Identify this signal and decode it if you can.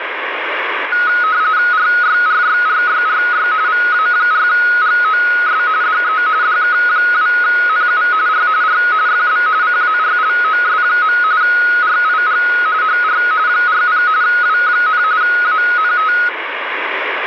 RTTY (45.45 baud, 170 Hz shift), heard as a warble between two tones, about 1360 Hz centre, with radio static. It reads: RYRYRYRY VA4GOS DE DK2NU R R FB CARLOS. RIG HR 40 W, ANT